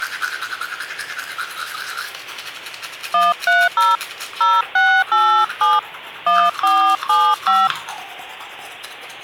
DTMF, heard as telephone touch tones, dialled by hand, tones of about 260 ms, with the noise of a restroom. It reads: 130 0687 1475